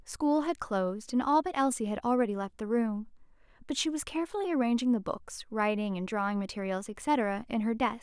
Speech in English. There is no code.